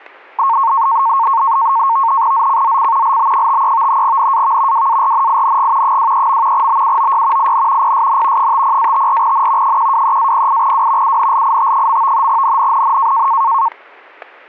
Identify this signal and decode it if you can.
NAVTEX (SITOR-B), 100 baud, 170 Hz shift, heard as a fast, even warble, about 1000 Hz centre, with static crashes. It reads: ZCZC LB53 NAV WARNING 23. BUOY IN PSN 50-54N 123-08W UNLIT. NNNN